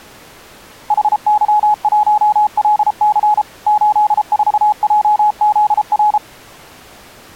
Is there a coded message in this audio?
Yes: Morse code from 0.8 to 6.2 s, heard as a keyed tone, machine-sent, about 33 wpm, 840 Hz. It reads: HY1LC 84JZR